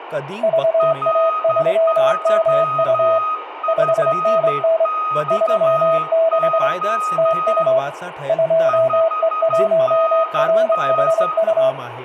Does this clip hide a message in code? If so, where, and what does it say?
Yes: Morse code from 0.4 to 11.8 s, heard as two keyed tones, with radio static and speech in Sindhi. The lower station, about 24 wpm, 650 Hz: VA3MU 5NN 36 TU 2E1RHU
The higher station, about 12 wpm, 1250 Hz: R3FXO 5NN